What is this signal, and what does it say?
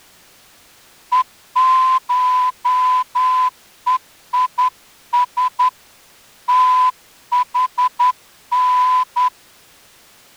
Morse code (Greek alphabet), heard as a whistle, hand-sent with a straight key, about 10 wpm. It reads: ΕΧΕΙΣ ΤΗΝ